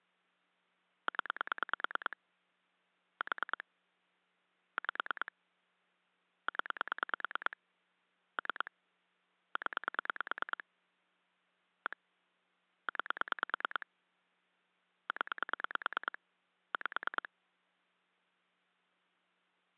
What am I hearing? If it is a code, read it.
Pulse dialling, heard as clicks on a phone line, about 9 pulses a second. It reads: 0 4 5 0 3 0 1 9 0 5